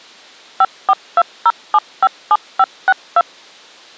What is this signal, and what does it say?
DTMF, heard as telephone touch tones, dialled by machine, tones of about 50 ms. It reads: 5420757562